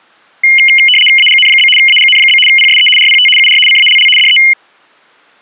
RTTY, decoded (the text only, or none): AGN? AGN? PSE RPT UR CALL DE